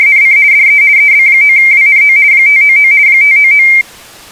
RTTY (50 baud, 170 Hz shift), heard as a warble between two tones, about 2200 Hz centre. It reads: … DE EB9WNO 599 599